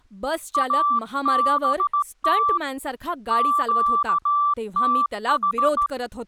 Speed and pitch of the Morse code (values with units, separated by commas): 16 wpm, 1170 Hz